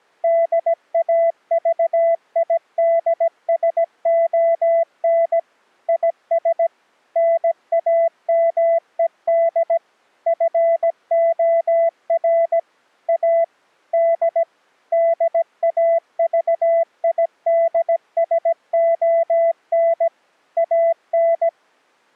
Morse code, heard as a keyed tone, machine-sent, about 17 wpm, 670 Hz. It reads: DAVIDSON IS NAMED FOR A D DAVIDSON AN